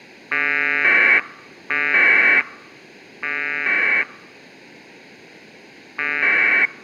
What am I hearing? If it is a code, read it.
Packet radio (AX.25, as in APRS), 1200 baud, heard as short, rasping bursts.